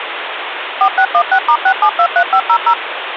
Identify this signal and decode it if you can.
DTMF, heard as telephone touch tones, dialled by machine, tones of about 80 ms, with phone line noise. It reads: 4616*6723500